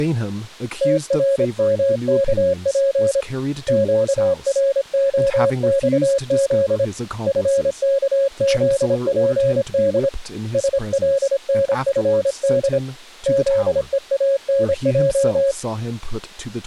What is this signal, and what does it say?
Morse code, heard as a keyed tone, hand-sent with a paddle, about 26 wpm, 550 Hz, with speech in English. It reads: TRMKP QROXZ FKZPD SLNFD ZEANJ